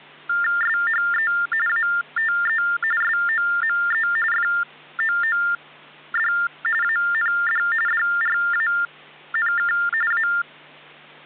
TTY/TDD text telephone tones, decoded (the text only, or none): SHE ATE SOME FOOD AND DRANK A